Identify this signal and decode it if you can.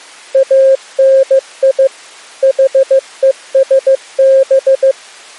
Morse code (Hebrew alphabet), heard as a keyed tone, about 15 wpm, 540 Hz. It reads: אני חושב